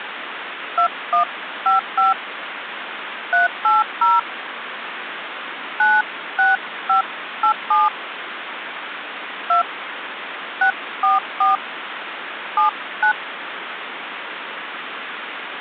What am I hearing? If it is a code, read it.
DTMF, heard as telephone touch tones, dialled by hand, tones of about 160 ms, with phone line noise. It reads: 2155 380 96587 2 644 79